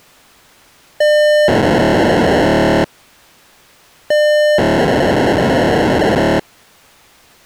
POCSAG pager data (1200 baud), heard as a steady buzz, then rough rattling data.